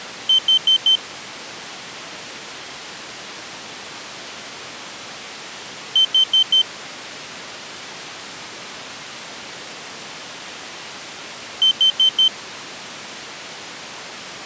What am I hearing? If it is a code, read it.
Alarm pattern, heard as an alarm's beeps, played three times, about 3100 Hz. Temporal four. Carbon monoxide.